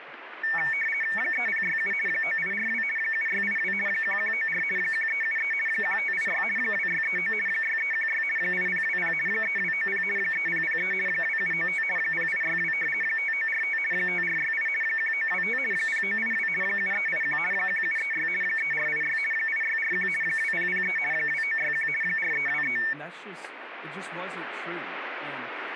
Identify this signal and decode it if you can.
RTTY (50 baud, 450 Hz shift), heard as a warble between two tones, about 2000 Hz centre, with radio static and speech in English. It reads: 3067 9842 7682 1194 1373 1586 2639 6316 8020 3290 3003 2795 0862 5945 5468 1925 0982 7381 1736 3486 8641 2003 2961 4323